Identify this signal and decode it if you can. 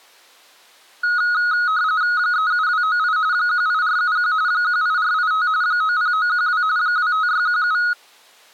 RTTY (45.45 baud, 170 Hz shift), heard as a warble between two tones, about 1360 Hz centre. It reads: 37298 18471 18485 90912 25617